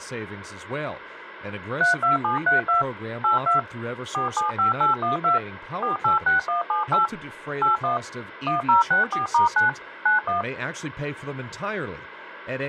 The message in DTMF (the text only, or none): 32732 82 475812 486178 81 1064*9 91